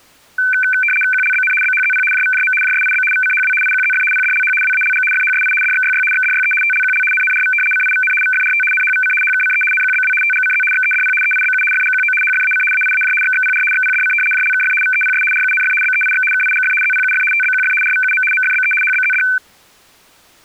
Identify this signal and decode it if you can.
RTTY (75 baud, 850 Hz shift), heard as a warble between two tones, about 1950 Hz centre. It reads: QLBN BHZP JVJM JSIB VCHW IQZF PDLH WALG FHSI DXYY XDYE TLQL NNRV CIVN VFRT NHVC HKCE NQBW TGCZ XEDP EIBU FGQO HFAC AIAJ XXPR XPDC JLKF VEPS RUNF BEIX KIGF ZPUF TBQF RVUM MFBE HBZD